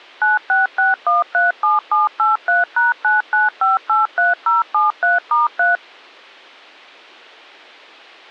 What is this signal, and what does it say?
DTMF, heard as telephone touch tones, dialled by machine, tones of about 160 ms. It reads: 966137783#99583073*3